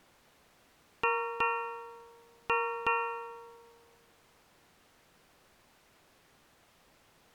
Ship's bell, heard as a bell. 4. Four half-hours of the watch have passed.